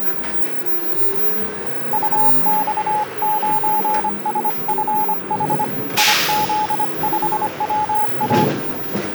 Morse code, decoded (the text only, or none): UX9SFH IZ5WA